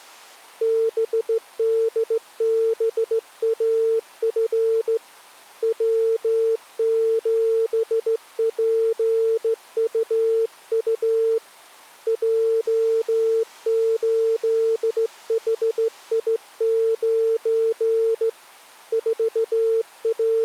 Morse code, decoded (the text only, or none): BDBAF W7PUU J8HI9 …